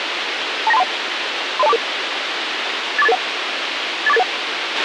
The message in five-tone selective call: 29231 30244 84881 84881

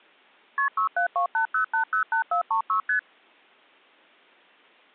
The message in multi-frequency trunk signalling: KP 67280808436 ST

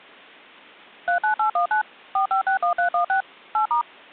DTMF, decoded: 39819 4561316 8*

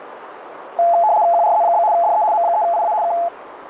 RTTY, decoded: QRZ? DE M3IA K

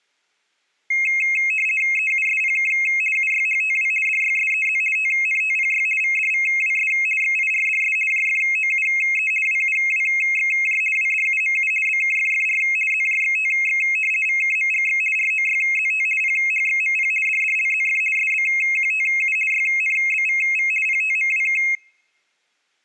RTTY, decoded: EUSPK UYHTW DYSEZ TNTPY VDVWS XIRDS JFOUE WUWXJ WDUMU BKFFR ZJXTX VKMGX ROYZT PHXMP DDLZF SBQTU YNBVV PTMWK

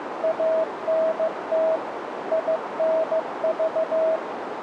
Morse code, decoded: ANT INV

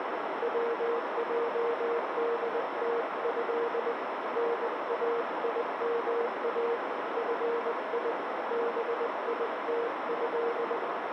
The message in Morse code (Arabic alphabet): وجدته نايما في بيته

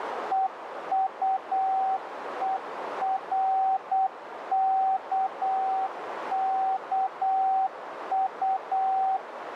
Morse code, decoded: EUERKKU

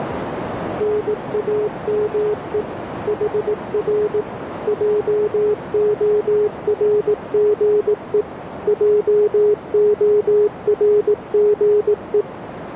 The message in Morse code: NAME HR JORGE JORGE

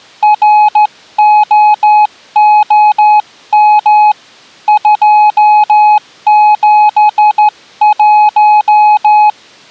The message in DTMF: none

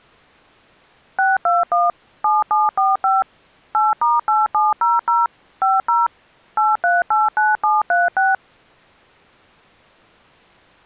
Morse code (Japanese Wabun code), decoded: none

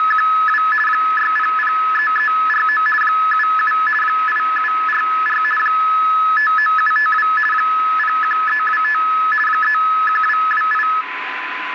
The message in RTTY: … 6003349 77 8744 59752 01325 31228

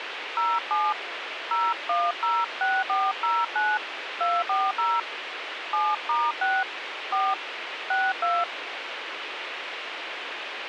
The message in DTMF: 07 0106409 240 7*6 4 62

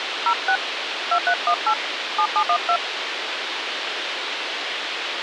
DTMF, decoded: 06 2318 7712

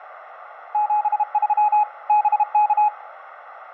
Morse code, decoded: 73 BK

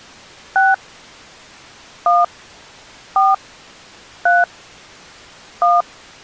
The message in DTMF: 6 1 4 3 1

